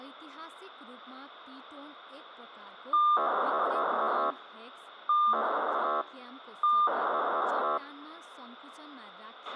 POCSAG pager data (2400 baud), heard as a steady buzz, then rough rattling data, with radio hiss, a squelch burst at the end and speech in Nepali.